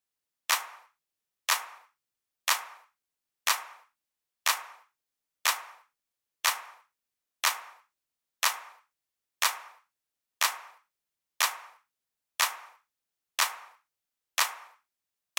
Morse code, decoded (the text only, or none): none